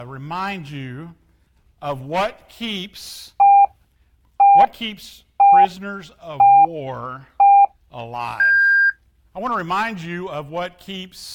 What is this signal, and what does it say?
Radio time signal (five pips and a higher one, as on Chinese radio), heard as pips.